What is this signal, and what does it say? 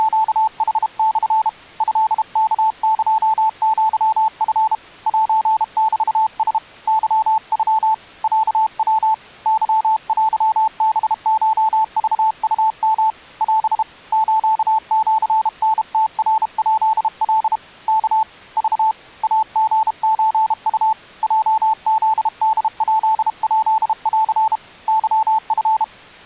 Morse code (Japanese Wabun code), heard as a keyed tone, hand-sent with a paddle, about 32 wpm, 880 Hz. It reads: … トワエアチ セメラ ケノ ロヤ ケテハコクウヨ オ スシタムナヱカ ワ ク イリソウ ヲフホヱヱン ケチ